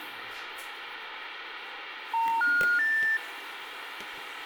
Telephone call progress tone (North American plan), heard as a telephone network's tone, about 910, 1430, 1800 Hz, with phone line noise, room echo and the noise of a restroom. Special information tone.